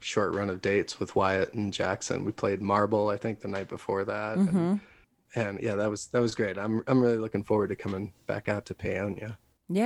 Speech in English. There is no code.